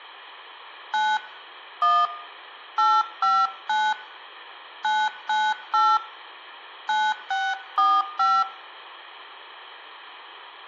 DTMF, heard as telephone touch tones, dialled by hand, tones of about 240 ms. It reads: 9 1 859 998 9645